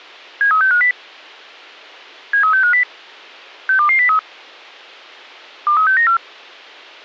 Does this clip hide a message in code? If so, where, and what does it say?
Yes: five-tone selective call (CCIR) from 0.4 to 6.2 s, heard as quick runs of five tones, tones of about 100 ms. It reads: 73650 73650 62203 23694